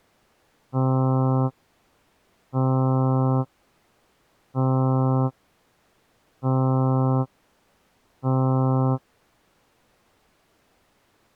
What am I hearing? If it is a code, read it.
Ship horn signal, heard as a ship's horn, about 130 Hz. 5 short. At sea: I doubt that you are doing enough to avoid a collision.